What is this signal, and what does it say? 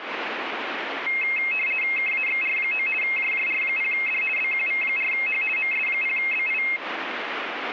RTTY (50 baud, 450 Hz shift), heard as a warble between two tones, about 2350 Hz centre, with radio static. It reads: KAXR9 JJR0D BQV4H MS0BI